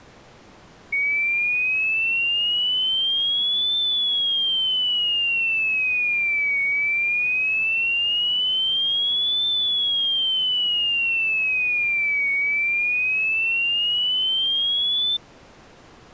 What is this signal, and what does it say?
A tone that sweeps in pitch again and again. There is no code.